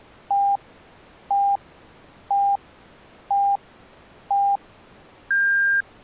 Radio time signal (five pips and a higher one, as on Chinese radio), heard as pips.